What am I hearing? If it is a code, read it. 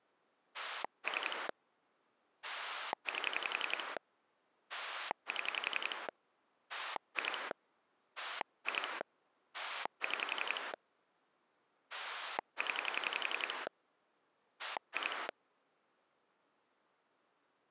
Pulse dialling, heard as a rotary dial, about 11 pulses a second. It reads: 3 8 7 2 2 6 0 2